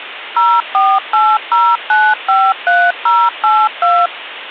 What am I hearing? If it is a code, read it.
DTMF, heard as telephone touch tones, dialled by machine, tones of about 240 ms, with phone line noise. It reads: 0480953082